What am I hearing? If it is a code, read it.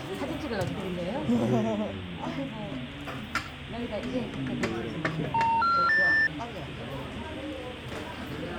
Telephone call progress tone (North American plan), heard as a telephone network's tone, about 910, 1370, 1800 Hz, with the noise of a restaurant. Special information tone.